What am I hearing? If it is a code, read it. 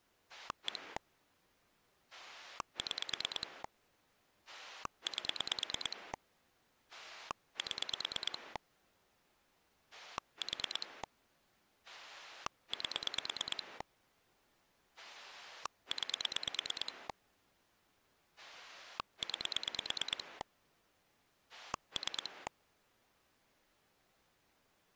Pulse dialling, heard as a rotary dial, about 9 pulses a second. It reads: 1 6 8 7 4 8 9 9 3